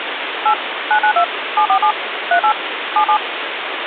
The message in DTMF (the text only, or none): 8 992 747 38 77